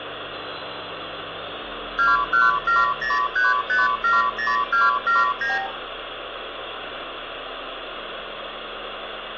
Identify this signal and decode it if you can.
Multi-frequency trunk signalling (R2, with the far end's replies), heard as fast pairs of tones, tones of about 170 ms, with phone line noise and room echo. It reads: 21703570279